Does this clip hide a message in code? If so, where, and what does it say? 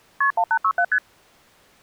Yes: multi-frequency trunk signalling (R1, as on North American trunks) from 0.2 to 1.0 s, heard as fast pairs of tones, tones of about 70 ms. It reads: KP 1867 ST